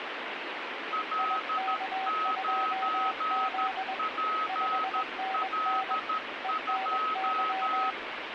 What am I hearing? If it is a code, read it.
Morse code, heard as two keyed tones, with radio static. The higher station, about 13 wpm, 1280 Hz: L9PL2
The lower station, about 21 wpm, 760 Hz: IK2Z 5NN ENY